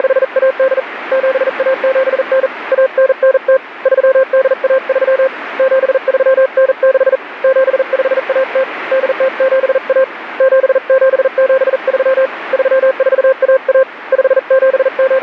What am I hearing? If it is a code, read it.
Morse code (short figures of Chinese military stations), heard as a keyed tone, hand-sent with a paddle, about 40 wpm, 530 Hz, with radio static. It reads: … 7179 1990 3813 7396 7510 8071 7773 3411 …